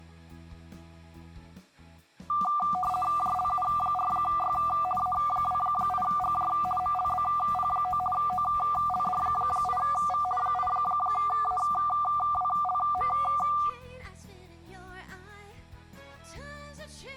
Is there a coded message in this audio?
Yes: RTTY (50 baud, 450 Hz shift) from 2.3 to 13.7 s, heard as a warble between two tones, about 960 Hz centre. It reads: JLU4Y A28GJ MLBP9 OLD8V 8AWLM